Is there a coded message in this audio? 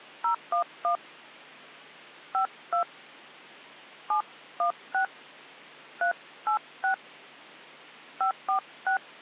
Yes: DTMF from 0.2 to 9.0 s, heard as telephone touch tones, dialled by hand, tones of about 100 ms. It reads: 011 52 716 386 546